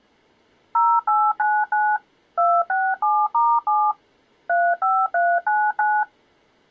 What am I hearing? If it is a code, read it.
DTMF, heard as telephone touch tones, dialled by machine, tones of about 240 ms. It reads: 0899 267*7 35399